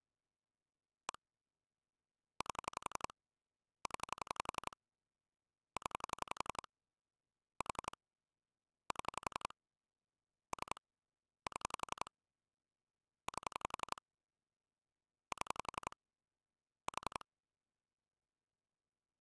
Pulse dialling, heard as clicks on a phone line, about 11 pulses a second. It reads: 1 8 0 0 4 7 3 7 8 7 4